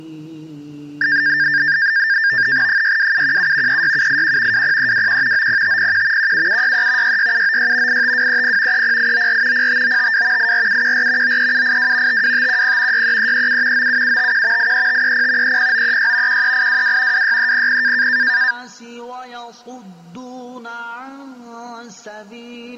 NAVTEX (SITOR-B), 100 baud, 170 Hz shift, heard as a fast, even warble, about 1700 Hz centre. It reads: 62717 36781 20321 90501 17763 66796 85230 30894 05952 84714 93782 52510 63337 97751 83530 30936 13822 26300